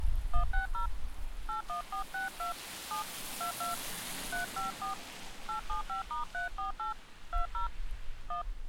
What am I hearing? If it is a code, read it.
DTMF, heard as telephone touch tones, dialled by hand, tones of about 120 ms. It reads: 160 81462 7 22 354 875*348 20 1